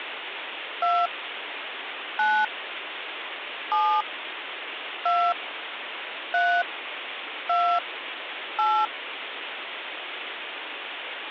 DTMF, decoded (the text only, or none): 2 9 7 2 3 2 8